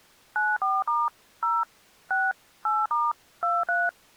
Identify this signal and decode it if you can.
DTMF, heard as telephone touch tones, dialled by machine, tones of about 210 ms. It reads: 94* 0 6 8* 23